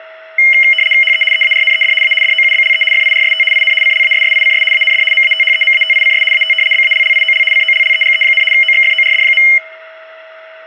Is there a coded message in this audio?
Yes: RTTY (75 baud, 850 Hz shift) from 0.4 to 9.6 s, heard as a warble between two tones, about 2550 Hz centre, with a steady whistle near 640 Hz and room echo. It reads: HE EARNED A DOUBLE FIRST IN CLASSICS AND MATHEMATICS AT BALLIOL COLLEGE, OXFORD.